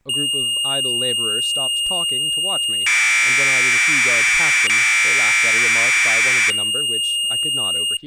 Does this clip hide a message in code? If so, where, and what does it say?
Yes: Commodore tape loading (standard loader) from 0.1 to 8.0 s, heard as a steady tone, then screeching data, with speech in English.